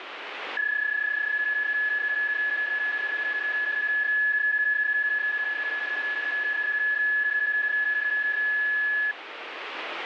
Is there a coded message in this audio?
Yes: PSK31 (31.25 baud) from 0.6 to 9.1 s, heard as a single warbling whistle, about 1700 Hz, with radio static.